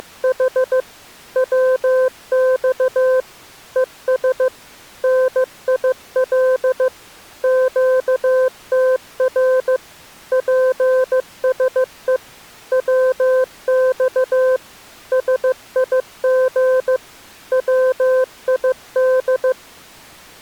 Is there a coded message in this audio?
Yes: Morse code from 0.0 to 19.6 s, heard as a keyed tone, machine-sent, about 15 wpm, 520 Hz. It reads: … WX ES NIL QTR PSE WX SIG WID